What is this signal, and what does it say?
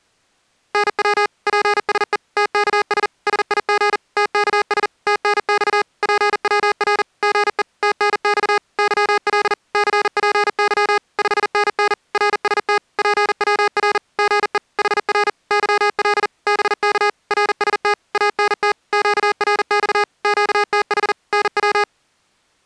Morse code, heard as electronic beeps, machine-sent, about 40 wpm, 410 Hz. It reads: NW PSE TKS SIG TKS TNX PWR GE TNX YL CPY 5NN RST PWR GE HR YL BK RST ANT QRX QTH NW